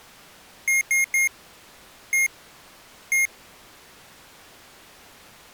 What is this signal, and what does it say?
Beep code, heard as beeps from a small speaker, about 2150 Hz. 3-1-1. In Phoenix BIOS tables: DMA register failure.